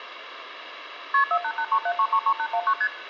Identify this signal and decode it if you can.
Multi-frequency trunk signalling (R1, as on North American trunks), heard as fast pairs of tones, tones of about 70 ms, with phone line noise. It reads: KP 48837333819 ST